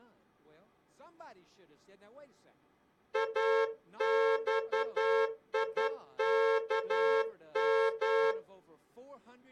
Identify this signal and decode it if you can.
Morse code, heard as a horn, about 11 wpm, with speech in English. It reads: AXIKM